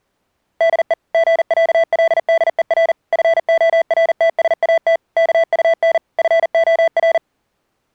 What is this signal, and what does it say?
Morse code (with Danish letters), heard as electronic beeps, machine-sent, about 40 wpm, 660 Hz. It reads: DE GÆLDER FORTSAT KUN FOR